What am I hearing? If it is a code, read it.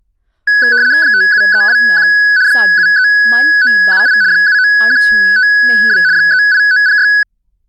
RTTY (75 baud, 170 Hz shift), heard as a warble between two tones, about 1600 Hz centre, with speech in Punjabi. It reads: 57321 73978 79152 38906